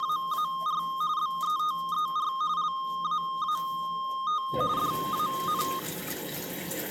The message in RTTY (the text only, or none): … BETER LAAT DAN